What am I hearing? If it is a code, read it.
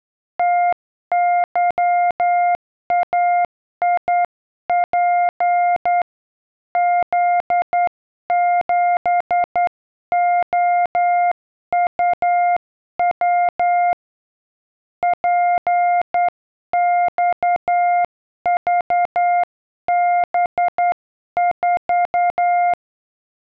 Morse code, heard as a keyed tone, hand-sent with a straight key, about 10 wpm, 700 Hz. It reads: TYAIP Z7OUW PXVB4